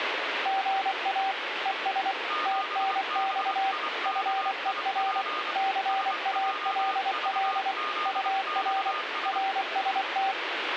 Morse code, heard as two keyed tones, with radio static. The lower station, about 24 wpm, 780 Hz: GA ES TNX FER CALL UR RST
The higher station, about 25 wpm, 1220 Hz: 7BIKIP SJVZXS